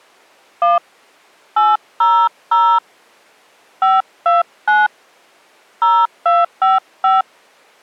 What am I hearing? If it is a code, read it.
DTMF, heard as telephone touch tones, dialled by hand, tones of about 190 ms. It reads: 1 800 529 0255